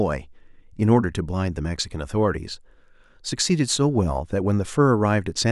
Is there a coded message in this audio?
No, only speech in English.